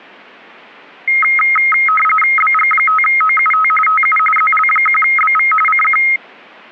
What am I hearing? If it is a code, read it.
RTTY (45.45 baud, 850 Hz shift), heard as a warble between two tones, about 1700 Hz centre. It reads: BG5OUT TU ZL1BV CQ